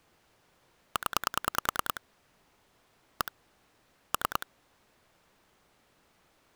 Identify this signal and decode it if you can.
Pulse dialling, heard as clicks on a phone line, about 10 pulses a second. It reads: 0 1 3